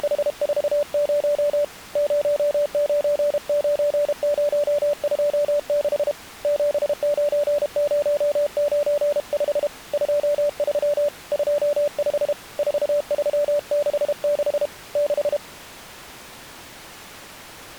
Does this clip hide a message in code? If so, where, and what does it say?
Yes: Morse code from 0.0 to 15.4 s, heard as a keyed tone, hand-sent with a paddle, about 32 wpm, 580 Hz. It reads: … 099026 79095 23 25 4366 6